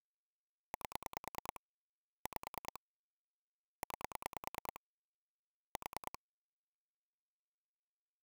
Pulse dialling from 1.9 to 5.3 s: 5 9

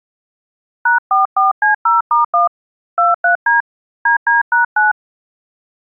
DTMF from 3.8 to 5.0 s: DD#9

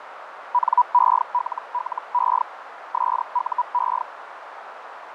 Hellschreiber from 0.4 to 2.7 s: NELLE

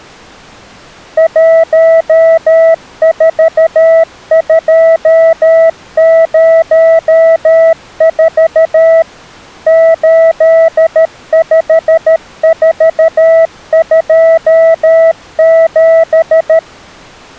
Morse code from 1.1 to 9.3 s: 14204

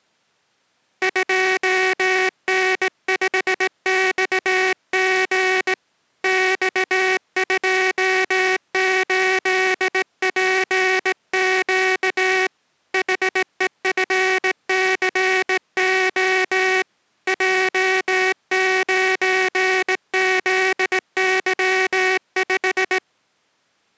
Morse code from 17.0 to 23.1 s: J9ZY5

